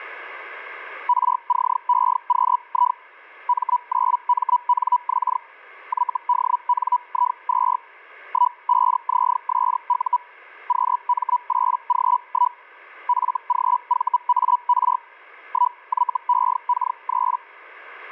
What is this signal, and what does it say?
Hellschreiber (Feld-Hell, 122.5 baud), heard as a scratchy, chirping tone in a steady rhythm, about 980 Hz. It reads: RCEQI M9MNX YDNI2 15ZSU QM8G1 FGVAR 1YEK3